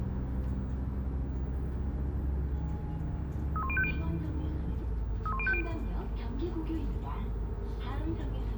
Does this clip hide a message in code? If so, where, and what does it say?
Yes: five-tone selective call (ZVEI) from 3.6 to 5.6 s, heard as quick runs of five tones, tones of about 70 ms, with the noise inside a bus. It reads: 31050 31050